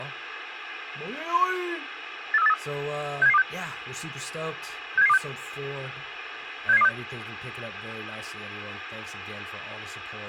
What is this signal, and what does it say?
Five-tone selective call (EEA), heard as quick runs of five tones, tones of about 40 ms, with radio hiss and speech in English. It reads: 84383 67726 67726 67726